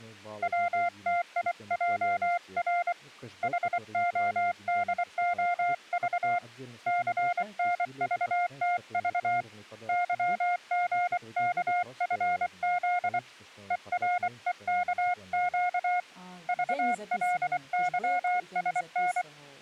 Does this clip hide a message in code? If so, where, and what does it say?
Yes: Morse code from 0.4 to 19.3 s, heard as a keyed tone, hand-sent with a paddle, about 24 wpm, 710 Hz, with speech in Russian. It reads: WTIJR HODOV CNVTV YGKFZ EREKQ VLYSN